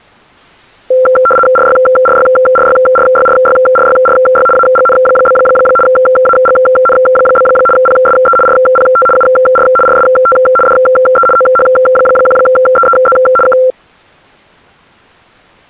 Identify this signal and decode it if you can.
RTTY (75 baud, 850 Hz shift), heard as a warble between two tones, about 940 Hz centre. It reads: RYRYRYRYRYRYRY AGN? AGN? PSE RPT UR RST DE OH1EEZ K